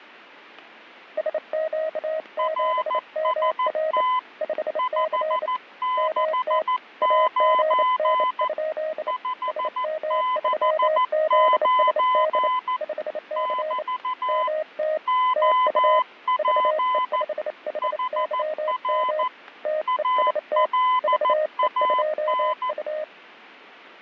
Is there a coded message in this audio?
Yes: Morse code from 1.1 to 23.1 s, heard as two keyed tones, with radio static and static crashes. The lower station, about 28 wpm, 620 Hz: SQ7MR 5C MT AGN? SM3ZSD 5C MT TU VE5HYM TEST VE2U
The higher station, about 14 wpm, 1010 Hz: RST 569 569 <BT> OP HR ALAN